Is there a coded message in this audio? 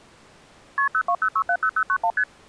Yes: multi-frequency trunk signalling (R1, as on North American trunks) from 0.8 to 2.2 s, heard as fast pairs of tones, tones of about 70 ms. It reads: KP 020670091 ST